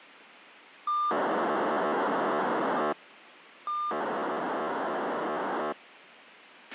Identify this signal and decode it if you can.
POCSAG pager data (2400 baud), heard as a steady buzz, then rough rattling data, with radio hiss and a squelch burst at the end.